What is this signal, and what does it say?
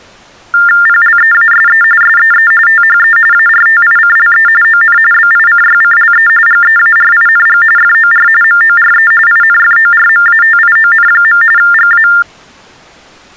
TTY/TDD text telephone tones (45.45 baud Baudot), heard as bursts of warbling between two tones, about 400 Hz shift, 1600 Hz centre. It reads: PLEASE SEE THE ARTICLE ON BICYCLE GEARING FOR MORE INFORMATION. GA